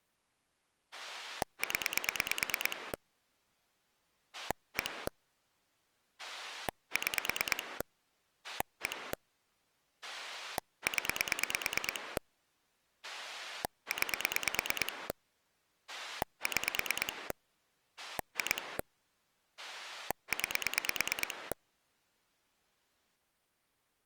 Pulse dialling, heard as a rotary dial, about 9 pulses a second. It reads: 0 1 6 1 0 9 6 2 9